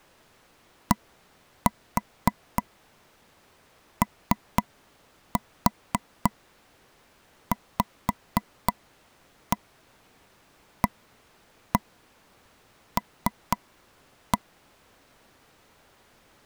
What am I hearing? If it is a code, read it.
Tap code, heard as taps on a table, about 3 knocks a second. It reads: DOVAL